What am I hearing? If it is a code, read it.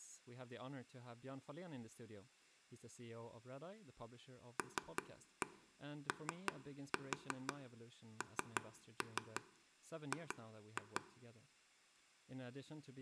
Tap code, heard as taps on a table, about 5 knocks a second, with room echo and speech in English. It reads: LONG